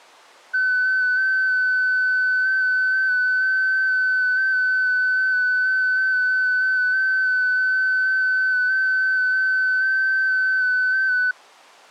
FT8 (one signal), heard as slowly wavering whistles, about 6.25 baud.